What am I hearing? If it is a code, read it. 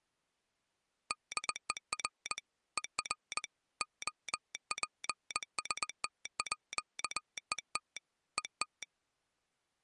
Morse code (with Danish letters), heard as a telegraph sounder, hand-sent with a paddle, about 20 wpm. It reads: DER ER OPSTÅET ET